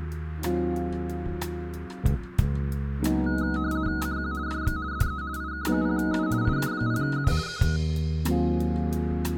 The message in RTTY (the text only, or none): CQ DX DE IK0U IK0U K